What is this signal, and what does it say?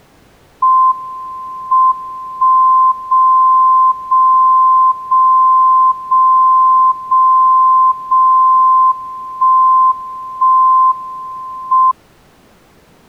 Radio time signal (WWVB), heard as a tone whose level steps once a second, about 1040 Hz. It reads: M 1 0 0 0 0 0 0 1 1 M